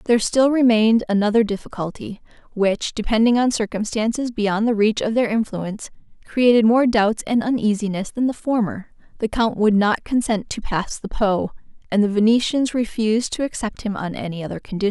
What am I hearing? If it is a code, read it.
Speech in English. There is no code.